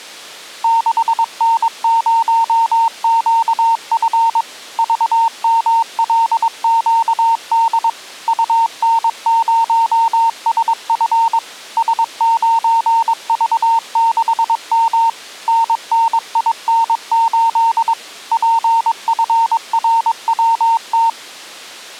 Morse code, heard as a keyed tone, machine-sent, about 22 wpm, 910 Hz. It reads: 6N0QF VMLQD UN0SF S9V6M NNIN8 PFRWT